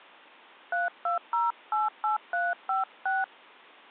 DTMF, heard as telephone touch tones, dialled by hand, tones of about 170 ms. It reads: 32088356